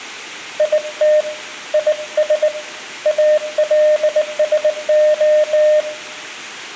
Morse code, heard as a keyed tone, hand-sent with a bug key, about 19 wpm, 610 Hz, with room echo. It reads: IT IS ALSO